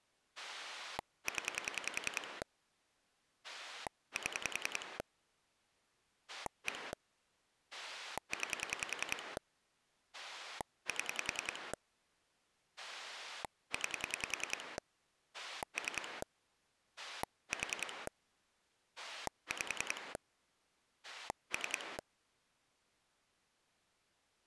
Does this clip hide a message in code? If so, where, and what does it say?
Yes: pulse dialling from 0.4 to 22.0 s, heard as a rotary dial, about 10 pulses a second. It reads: 0 7 1 9 7 9 3 4 5 3